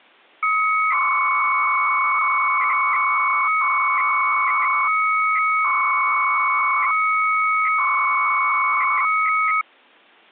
300-baud modem data (Bell 103 tones), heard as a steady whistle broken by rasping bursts, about 300 baud, 200 Hz shift.